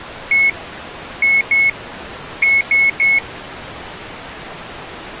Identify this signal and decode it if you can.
Beep code, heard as beeps from a small speaker, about 2200 Hz. 1-2-3. In Phoenix BIOS tables: DMA page register failure.